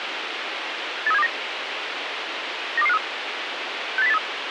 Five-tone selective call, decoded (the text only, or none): 83729 92253 68083